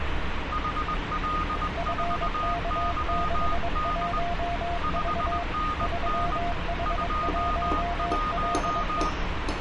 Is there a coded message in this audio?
Yes: Morse code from 0.5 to 9.2 s, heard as two keyed tones, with radio static and street noise. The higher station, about 20 wpm, 1230 Hz: HL4YD 5NN 21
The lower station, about 22 wpm, 700 Hz: FK61V 3H1LE